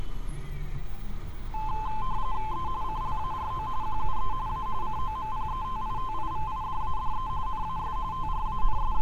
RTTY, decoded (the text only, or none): E CLARO QUE A COMPETITIVIDADE NAS …